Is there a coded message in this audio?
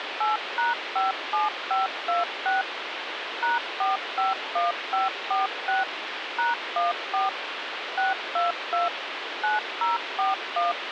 Yes: DTMF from 0.2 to 10.7 s, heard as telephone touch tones, dialled by machine, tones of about 160 ms, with phone line noise. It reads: 8#57526 #451546 #14 622 9041